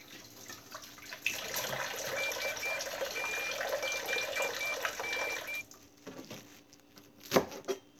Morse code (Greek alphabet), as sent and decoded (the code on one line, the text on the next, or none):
... - .... -.
ΣΤΗΝ